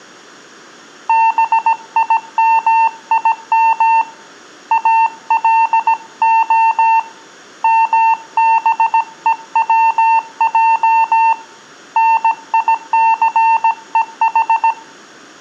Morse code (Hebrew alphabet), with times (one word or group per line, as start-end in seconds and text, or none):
1.1-4.0 בימים
4.7-7.0 אלה
7.6-11.3 מבוצע
12.0-14.7 ניסוח